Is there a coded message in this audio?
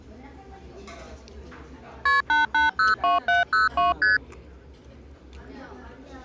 Yes: multi-frequency trunk signalling (R1, as on North American trunks) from 2.1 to 4.2 s, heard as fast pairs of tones, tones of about 150 ms, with the noise of a restaurant. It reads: KP 8802702 ST